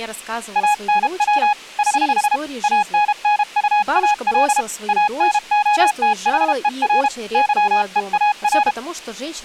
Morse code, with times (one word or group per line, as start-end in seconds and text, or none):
0.6-1.5 ANW
1.8-2.4 <HH>
2.6-4.6 ANNUAL
4.9-7.1 ANOTHER
7.3-8.7 YEAR